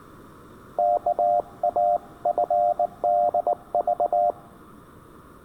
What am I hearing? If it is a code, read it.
Morse code (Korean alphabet), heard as a keyed tone, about 19 wpm, 700 Hz. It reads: 오늘